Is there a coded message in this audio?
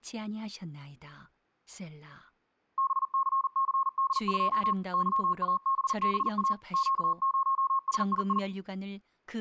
Yes: Morse code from 2.7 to 8.4 s, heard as a keyed tone, machine-sent, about 40 wpm, 1080 Hz, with speech in Korean. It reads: BCCD2 YABBA Q0SII